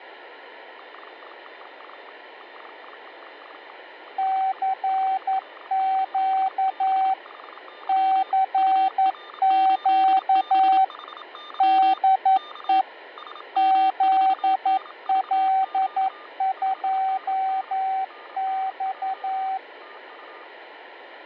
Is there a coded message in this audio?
Yes: Morse code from 0.7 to 20.5 s, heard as two keyed tones, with radio static, fading and room echo. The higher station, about 27 wpm, 1200 Hz: CQ CQ DE UR8BHY UR8BHY K SM4NVQ 5NN NNJ TU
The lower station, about 11 wpm, 770 Hz: CQ CQ DE ZL2X